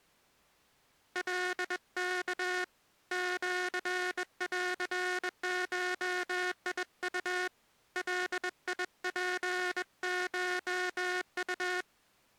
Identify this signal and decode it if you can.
Morse code (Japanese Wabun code), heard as a buzzer, hand-sent with a bug key, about 21 wpm. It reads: カワ シンゴウ ガツコウ